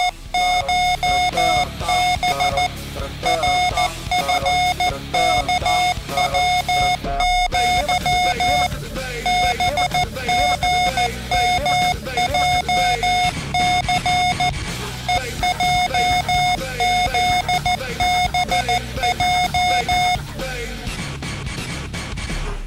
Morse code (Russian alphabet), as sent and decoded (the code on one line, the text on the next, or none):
… / .-. ..-. -.- .-- --.-- / -... --. -- .--- -.-. / . .--- --.. -... .---
… РФКВЪ БГМЙЦ ЕЙЗБЙ